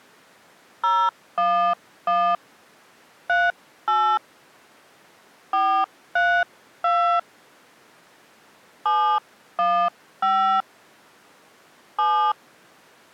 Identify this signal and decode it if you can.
DTMF, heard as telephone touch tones, dialled by hand, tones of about 290 ms. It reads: 011 38 432 715 7